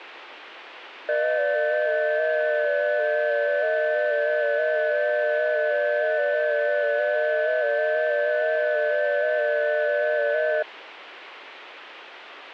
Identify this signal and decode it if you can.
FT8 (several signals at once), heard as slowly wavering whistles, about 6.25 baud, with radio static.